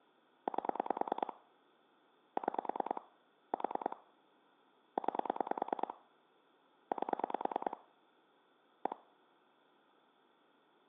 Pulse dialling, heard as clicks on a phone line, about 9 pulses a second. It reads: 8 6 4 9 8 1